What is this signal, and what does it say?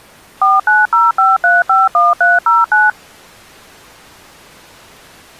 DTMF, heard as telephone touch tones, dialled by machine, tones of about 180 ms. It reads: 4905351309